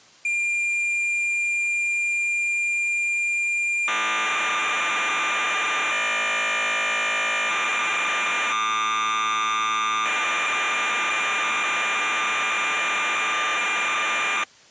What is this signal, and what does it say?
Cassette data (Kansas City type), 1200 baud, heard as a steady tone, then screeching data.